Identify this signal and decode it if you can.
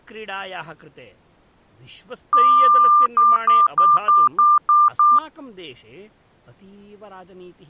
Beep code, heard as beeps, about 1190 Hz, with speech in Sanskrit. 1 long, 7 short.